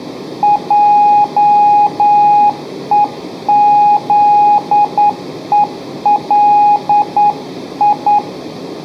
Morse code, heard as a keyed tone, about 9 wpm, 830 Hz, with room echo. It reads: JEZELI